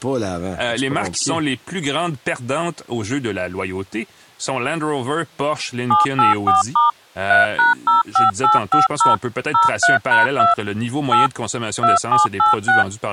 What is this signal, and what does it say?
DTMF, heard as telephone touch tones, dialled by machine, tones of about 150 ms, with speech in French. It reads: 784* 3#05850 03#2 8 2786